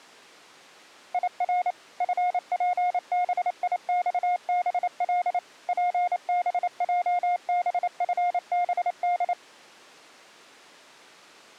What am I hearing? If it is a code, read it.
Morse code, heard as a keyed tone, machine-sent, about 28 wpm, 710 Hz. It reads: IR FPBIXBL PBJBFBD